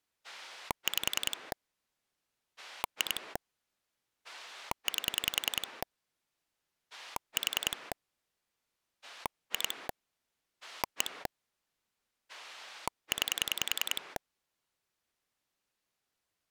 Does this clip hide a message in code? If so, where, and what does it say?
Yes: pulse dialling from 0.2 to 14.2 s, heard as a rotary dial, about 10 pulses a second. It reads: 5 2 8 4 2 1 9